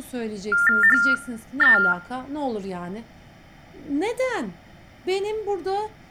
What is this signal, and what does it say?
TTY/TDD text telephone tones (45.45 baud Baudot), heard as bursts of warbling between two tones, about 400 Hz shift, 1600 Hz centre, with speech in Turkish. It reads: HE